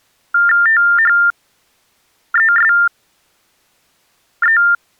TTY/TDD text telephone tones (45.45 baud Baudot), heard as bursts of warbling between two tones, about 400 Hz shift, 1600 Hz centre. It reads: THESE